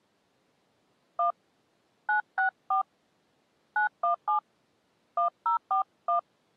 DTMF, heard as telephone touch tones, dialled by hand, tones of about 110 ms. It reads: 1 964 917 1041